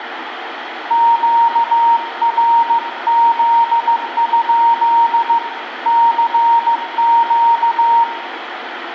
Morse code, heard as a keyed tone, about 15 wpm, 930 Hz, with radio static and room echo. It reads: QRZ? CQ